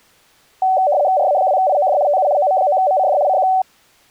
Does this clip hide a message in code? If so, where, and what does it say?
Yes: RTTY (75 baud, 170 Hz shift) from 0.6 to 3.6 s, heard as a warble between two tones, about 670 Hz centre. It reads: RA2IOD TU OM9MCD CQ